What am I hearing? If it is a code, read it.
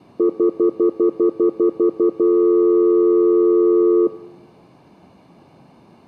Telephone call progress tone (North American plan), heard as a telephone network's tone, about 350, 440 Hz, 0.1 s on and 0.1 s off. Stutter dial tone.